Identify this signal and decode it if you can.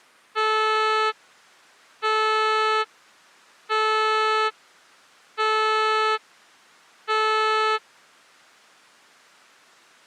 Ship horn signal, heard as a ship's horn, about 440 Hz. 5 short. At sea: I doubt that you are doing enough to avoid a collision.